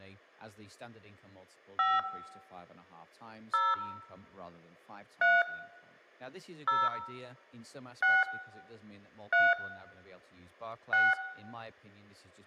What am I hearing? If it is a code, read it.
DTMF, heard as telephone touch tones, dialled by hand, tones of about 210 ms, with room echo and speech in English. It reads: 5 0 3 0 6 3 6